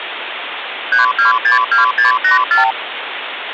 Multi-frequency trunk signalling (R2, with the far end's replies), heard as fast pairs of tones, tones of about 130 ms, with phone line noise. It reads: 3262684